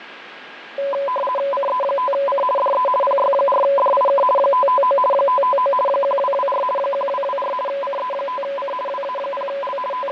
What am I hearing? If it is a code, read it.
RTTY (50 baud, 450 Hz shift), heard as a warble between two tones, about 780 Hz centre, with radio static, fading and a steady whistle near 1630 Hz. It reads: CE5C DE PY4DIK 559 559 1224 1224 CE5C WA0L …